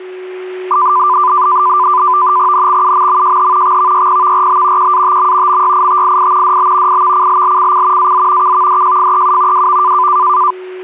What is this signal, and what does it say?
NAVTEX (SITOR-B), 100 baud, 170 Hz shift, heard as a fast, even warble, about 1100 Hz centre, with a steady whistle near 370 Hz. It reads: NXUMMJH XVYPVRB QATM MYITII DB IVCLLCC AZ KVDJFEU WV